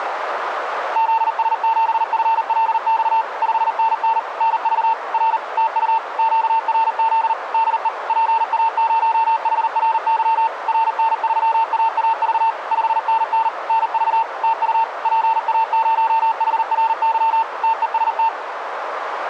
Morse code, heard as a keyed tone, machine-sent, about 39 wpm, 900 Hz, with radio static and a narrow filter. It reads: ZS7FLX 5NN NV R TU QRZ DE PA0HRY RN3AAV 5NN NV TU PA0HRY TEST